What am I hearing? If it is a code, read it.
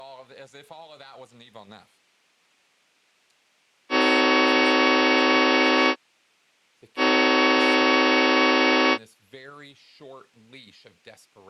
Train horn signal, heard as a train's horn, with speech in English. 2 long. On North American railways: brakes released, proceed.